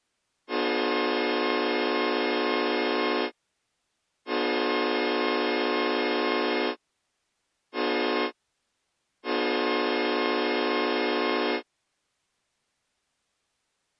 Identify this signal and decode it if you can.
Train horn signal, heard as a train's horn. 2 long, 1 short, 1 long. On North American railways: approaching a public crossing.